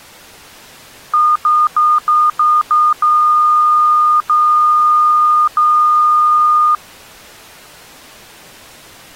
Beep code, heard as beeps, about 1220 Hz. 6 short, 3 long.